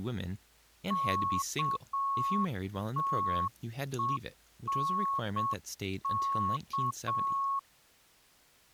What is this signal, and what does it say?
Morse code, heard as a keyed tone, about 7 wpm, 1100 Hz, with speech in English. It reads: KTENK